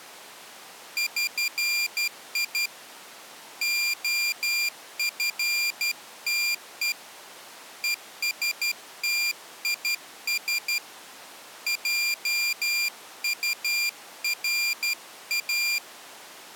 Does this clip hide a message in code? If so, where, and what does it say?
Yes: Morse code (with Esperanto letters) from 0.9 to 15.8 s, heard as a high beeper, hand-sent with a straight key, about 12 wpm, 2400 Hz. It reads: ŜI OFTE ESTIS JURA